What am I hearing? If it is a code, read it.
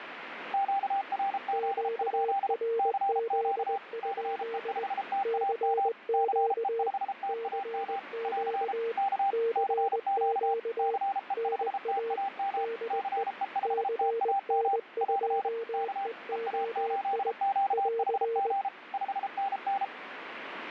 Morse code, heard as two keyed tones, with radio static. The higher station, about 33 wpm, 790 Hz: QRZ? CQ CE5TAM CE5TAM <AR> K CQ CE5TAM CE5TAM <AR> K EA8QHG 5NN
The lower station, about 20 wpm, 460 Hz: QRZ? CQ CQ CQ NA DE CN2EOI <AR>